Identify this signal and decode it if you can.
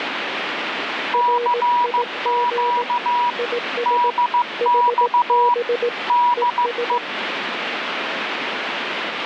Morse code, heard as two keyed tones, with radio static. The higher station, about 15 wpm, 970 Hz: CQ DX DE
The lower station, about 18 wpm, 480 Hz: RIG IS HB ES